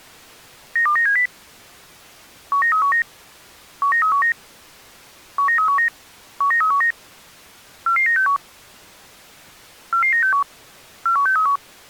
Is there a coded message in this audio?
Yes: five-tone selective call (CCIR) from 0.8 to 11.6 s, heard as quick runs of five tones, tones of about 100 ms. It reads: 92970 19319 19319 19319 19319 44961 44961 41631